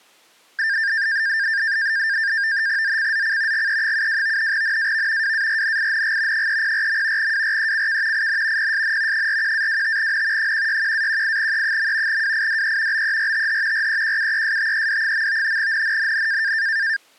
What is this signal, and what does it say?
NAVTEX (SITOR-B), 100 baud, 170 Hz shift, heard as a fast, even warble, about 1700 Hz centre. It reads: ZCZC GE72 NAV WARNING 304. WRECK IN PSN 41-25N 161-18E. WIDE BERTH REQUESTED. NNNN